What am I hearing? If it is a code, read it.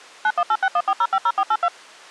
DTMF, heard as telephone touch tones, dialled by machine, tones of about 60 ms. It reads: 918614050482